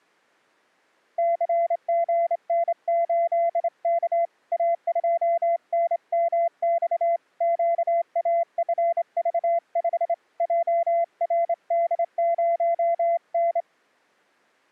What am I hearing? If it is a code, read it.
Morse code, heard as a keyed tone, hand-sent with a straight key, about 27 wpm, 680 Hz. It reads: CGN8K A2NMX QAFV5 JRD0N